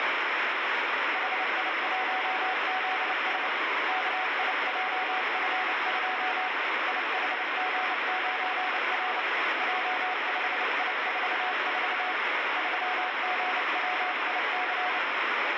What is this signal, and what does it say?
Morse code, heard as a keyed tone, hand-sent with a paddle, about 29 wpm, 740 Hz, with heavy radio static. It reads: HI1ZS KIJF2 IHG9R J5I44 3GWIC